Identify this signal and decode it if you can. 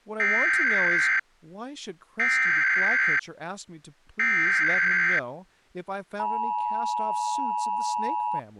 Emergency Alert System (SAME) tones (header bursts, then the 853 and 960 Hz attention tone), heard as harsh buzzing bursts, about 520.83 baud, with speech in English.